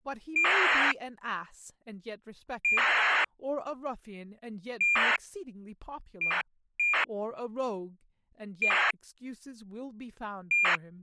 ACARS aircraft data, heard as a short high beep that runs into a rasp, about 2400 baud, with speech in English.